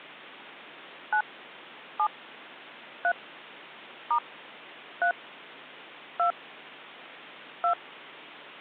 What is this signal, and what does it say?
DTMF, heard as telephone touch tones, dialled by hand, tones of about 80 ms. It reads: 9 7 3 * 3 2 2